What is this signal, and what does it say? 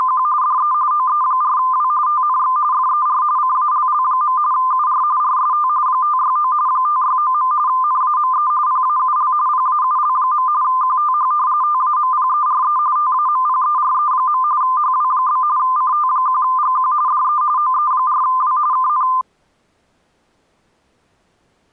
RTTY (45.45 baud, 170 Hz shift), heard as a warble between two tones, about 1110 Hz centre. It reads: … DE OE4W TNX FER CALL. UR RST 569 569. NAME PAUL PAUL. QTH TAMPERE TAMPERE. HW? CT1GQ DE OE4W KN